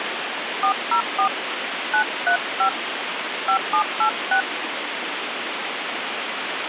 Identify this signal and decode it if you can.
DTMF, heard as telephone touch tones, dialled by hand, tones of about 90 ms, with phone line noise. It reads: 404 935 5786